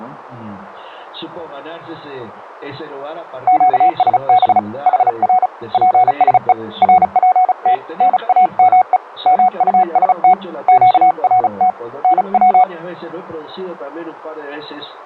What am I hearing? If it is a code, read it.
Morse code, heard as a keyed tone, hand-sent with a paddle, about 35 wpm, 740 Hz. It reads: QSB HR PSE RPT NAME MUST QRT NW